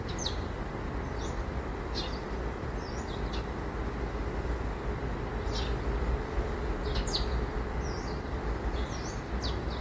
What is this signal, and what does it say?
The noise of a park. There is no code.